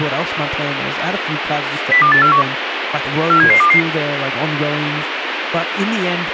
Five-tone selective call (CCIR), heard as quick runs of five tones, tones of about 100 ms, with radio hiss and speech in English. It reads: 02841 47722